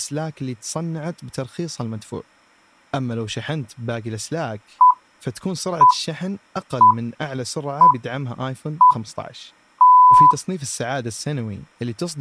Radio time signal (six pips, as the Greenwich Time Signal), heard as pips, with speech in Arabic.